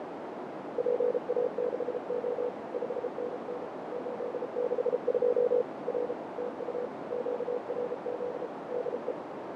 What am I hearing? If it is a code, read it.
Morse code, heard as a keyed tone, machine-sent, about 33 wpm, 490 Hz, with heavy radio static, fading and a narrow filter. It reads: PA6O 5NN 862 R TU QRZ DE